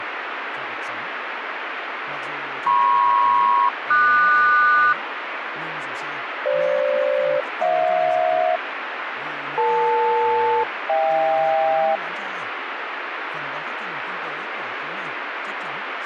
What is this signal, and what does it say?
Aircraft SELCAL, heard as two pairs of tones, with radio static and speech in Vietnamese. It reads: MP-QS FG-HJ EL-HK